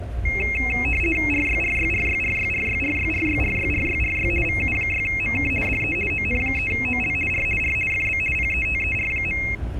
RTTY (50 baud, 450 Hz shift), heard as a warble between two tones, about 2350 Hz centre, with the noise inside a subway train. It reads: RYRYRYRYRYRYRYRYRYRY VU6MK DE ON3OL R R FB PETER.